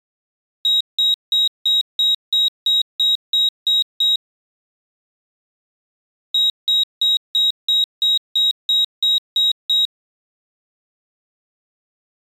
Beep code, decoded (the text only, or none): 11 short